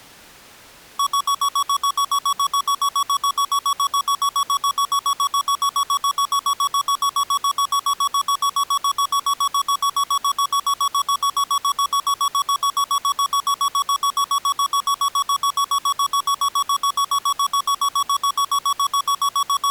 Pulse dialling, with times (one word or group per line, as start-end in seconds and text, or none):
none